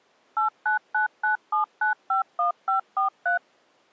DTMF, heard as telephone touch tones, dialled by machine, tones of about 120 ms. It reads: 89997951543